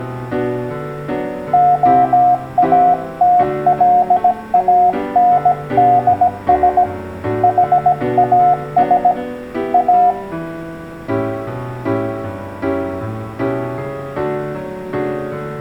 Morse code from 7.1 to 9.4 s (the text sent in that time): HAS